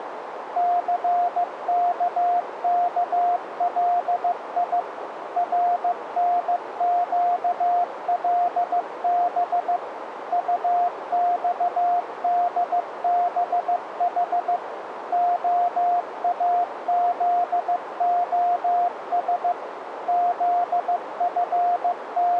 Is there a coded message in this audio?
Yes: Morse code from 0.5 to 22.4 s, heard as a keyed tone, machine-sent, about 15 wpm, 710 Hz, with radio static and a narrow filter. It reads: CKKLI RNQLB UXDBH OAZOS …